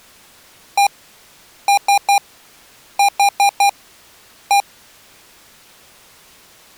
Beep code, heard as beeps from a small speaker, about 800 Hz. 1-3-4-1. In Phoenix BIOS tables: memory failure on an address line.